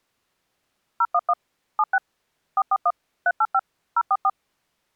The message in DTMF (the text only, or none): 011 76 441 385 044